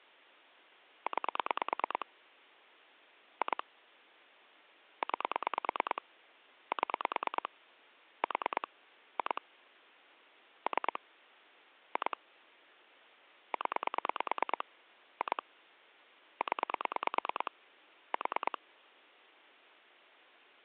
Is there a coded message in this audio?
Yes: pulse dialling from 1.1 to 18.6 s, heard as clicks on a phone line, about 9 pulses a second. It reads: 9 2 9 7 4 2 3 2 0 2 0 4